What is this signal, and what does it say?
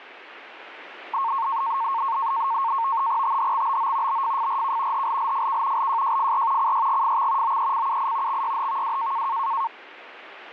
NAVTEX (SITOR-B), 100 baud, 170 Hz shift, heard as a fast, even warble, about 1000 Hz centre, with radio static. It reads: THXBO BFFRK HLLFK LJJFR CYGFX OECUI XYHVW